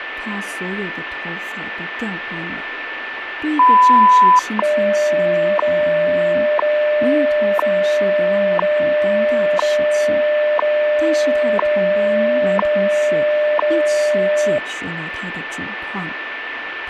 Radio time signal (WWV, Colorado), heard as ticks, one a second, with radio static, a steady whistle near 1770 Hz and speech in Chinese.